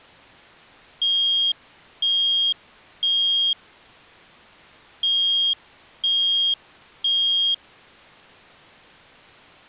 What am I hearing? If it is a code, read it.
Alarm pattern, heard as an alarm's beeps, played twice, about 3250 Hz. Temporal three. Smoke or fire, evacuate.